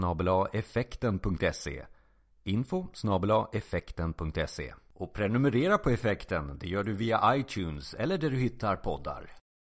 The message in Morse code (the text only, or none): none